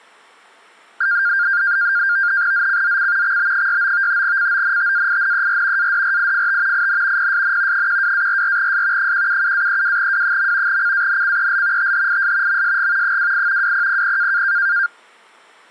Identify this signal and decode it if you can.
NAVTEX (SITOR-B), 100 baud, 170 Hz shift, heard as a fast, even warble, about 1500 Hz centre. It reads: ZCZC XB69 CONTAINER ADRIFT IN PSN 12-44S 177-32W. CANCEL THIS MSG 28 2000